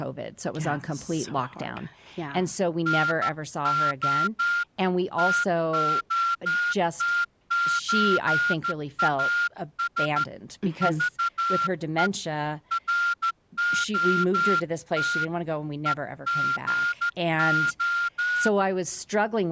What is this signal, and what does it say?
Morse code (Russian alphabet), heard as a whistle, hand-sent with a straight key, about 13 wpm, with speech in English. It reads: НО ТОТЧАС ЖЕ РОТ ЕГО